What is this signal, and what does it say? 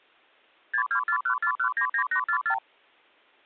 Multi-frequency trunk signalling (R2, with the far end's replies), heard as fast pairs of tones, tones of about 90 ms. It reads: 62414199844